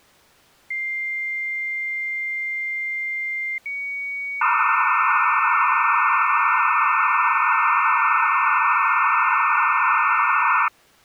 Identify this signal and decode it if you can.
Dial-up modem handshake (low-speed, two carriers), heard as two whistles, then hiss.